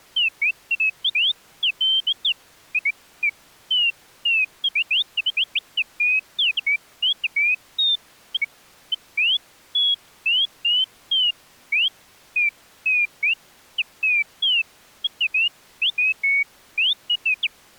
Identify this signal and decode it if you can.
Bird-like chirps. There is no code.